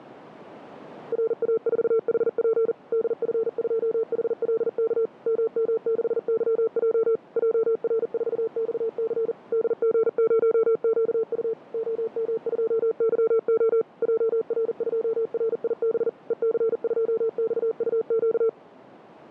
Morse code, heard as a keyed tone, machine-sent, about 40 wpm, 450 Hz, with radio static. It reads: RA4HP DF2HLK MM6YJ JR4XC DG0QU OM2YO JR2RIB EC2XUQ